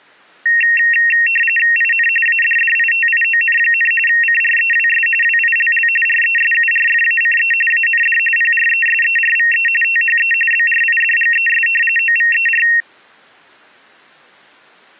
RTTY (45.45 baud, 850 Hz shift), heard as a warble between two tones, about 2300 Hz centre. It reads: IN ADDITION, CREWS WILL RESURFACE AND PRESERVE THE BRIDGES OVER